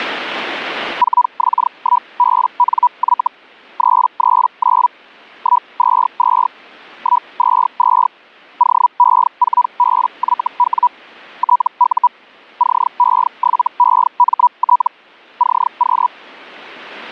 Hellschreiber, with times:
1.0-3.3 4X1BNY
3.8-4.9 339
5.4-6.5 122
7.0-8.1 122
8.6-10.9 OE4BYW
11.4-12.1 TU
12.6-14.9 CE7EMT
15.4-16.1 CQ

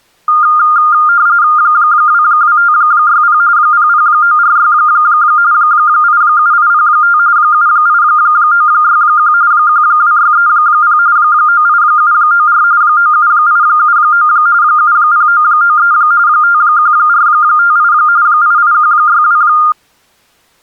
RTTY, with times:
1.6-3.4 22560
3.6-4.7 00946
5.5-7.2 87805
7.4-9.3 78961
9.5-11.0 12630
11.2-12.6 98794
12.8-14.3 97879
14.6-15.9 70993
16.3-17.9 51458
18.3-19.4 88162

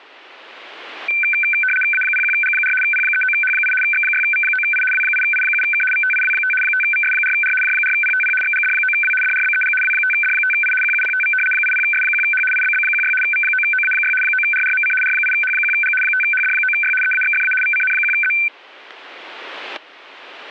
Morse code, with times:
none

